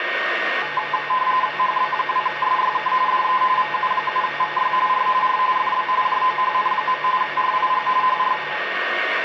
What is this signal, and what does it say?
RTTY (45.45 baud, 170 Hz shift), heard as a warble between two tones, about 940 Hz centre, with radio static, a steady whistle near 1850 Hz and room echo. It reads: HB2SYK DE VU7VY R R FB JOHN. RIG HR